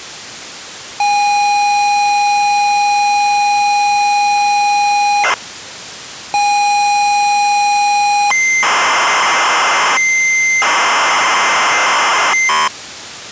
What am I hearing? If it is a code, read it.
ZX Spectrum tape loading, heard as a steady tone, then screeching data.